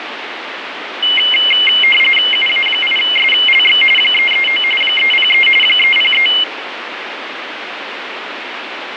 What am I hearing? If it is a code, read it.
RTTY (45.45 baud, 850 Hz shift), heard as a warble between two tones, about 2550 Hz centre, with radio static. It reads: UA8SLX 339 303 303